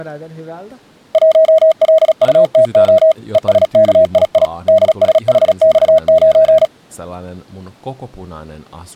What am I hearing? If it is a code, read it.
Morse code, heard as a keyed tone, machine-sent, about 36 wpm, 640 Hz, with speech in Finnish. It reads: 1LUTO ESKII DSHX9